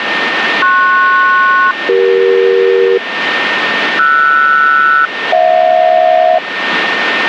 Aircraft SELCAL, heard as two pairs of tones, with radio static and a steady whistle near 1820 Hz. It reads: PS-CE RS-HJ